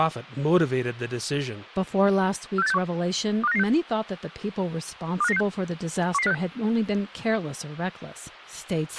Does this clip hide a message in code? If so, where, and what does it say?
Yes: five-tone selective call (EEA) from 2.6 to 6.3 s, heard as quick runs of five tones, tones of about 40 ms, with a squelch burst at the end and speech in English. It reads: 46861 25996 25996 11056